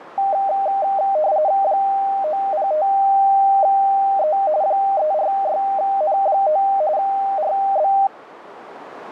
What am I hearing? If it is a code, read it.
RTTY (45.45 baud, 170 Hz shift), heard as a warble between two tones, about 700 Hz centre, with radio static. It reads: 905E 346N9 RB